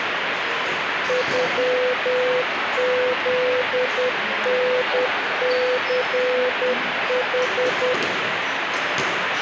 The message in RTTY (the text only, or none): none